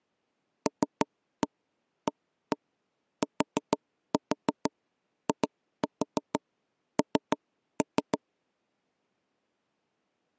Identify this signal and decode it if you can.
Tap code, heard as knocks on wood, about 6 knocks a second. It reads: LATIN